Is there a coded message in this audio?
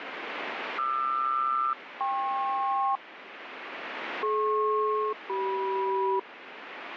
Yes: aircraft SELCAL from 0.8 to 6.2 s, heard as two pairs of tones, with radio static. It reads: QR-KP DP-CM